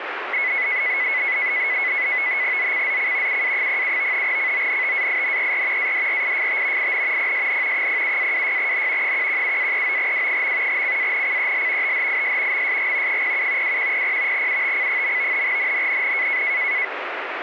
NAVTEX (SITOR-B), 100 baud, 170 Hz shift, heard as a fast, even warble, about 2100 Hz centre, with radio static. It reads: ZCZC UA07 CONTAINER ADRIFT IN PSN 07-26N 117-39W. CANCEL THIS MSG 07 2100 UTC. NNNN